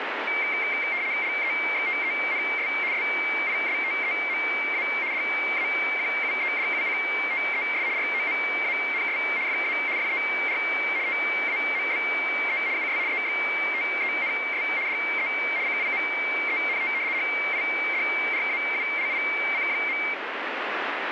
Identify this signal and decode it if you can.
RTTY (75 baud, 170 Hz shift), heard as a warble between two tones, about 2200 Hz centre, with radio static. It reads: LEXTENS SISTEMA DAQUEDUCTES ROMANS FA FER TAMBE US EXTENS DE CIMENT HIDRAULIC.